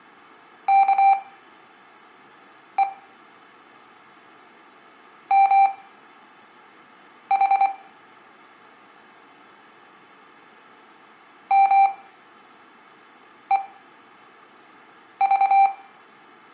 Morse code (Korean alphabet), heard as electronic beeps, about 24 wpm, spaced as for 5 wpm, 790 Hz, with room echo. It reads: 아무 말